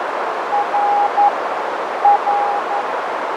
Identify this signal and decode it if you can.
Morse code, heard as a keyed tone, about 11 wpm, 820 Hz, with heavy radio static, fading and a narrow filter. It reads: R R